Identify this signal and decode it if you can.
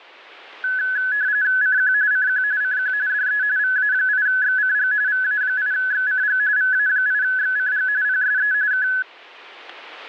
RTTY (45.45 baud, 170 Hz shift), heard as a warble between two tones, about 1600 Hz centre. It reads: CQ CQ CQ DE VA8XCG VA8XCG VA8XCG PSE K